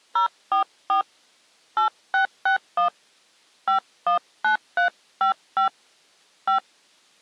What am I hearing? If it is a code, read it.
DTMF, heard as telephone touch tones, dialled by hand, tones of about 110 ms. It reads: 044 8661 519355 5